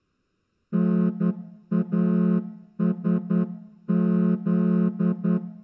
Morse code, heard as a horn, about 10 wpm. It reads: NASZ